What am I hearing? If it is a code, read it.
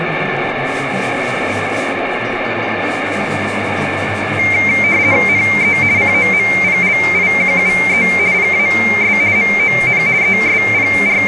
RTTY (50 baud, 170 Hz shift), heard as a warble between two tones, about 2200 Hz centre, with radio static. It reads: NE COMPLIQUE PAS MON …